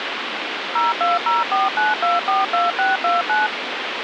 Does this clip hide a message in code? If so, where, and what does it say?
Yes: DTMF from 0.8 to 3.5 s, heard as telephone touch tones, dialled by machine, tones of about 170 ms, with phone line noise. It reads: 02049242629